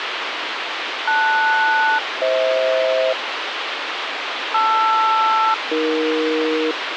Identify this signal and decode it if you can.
Aircraft SELCAL, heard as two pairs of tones, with radio hiss. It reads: LS-FH LR-AE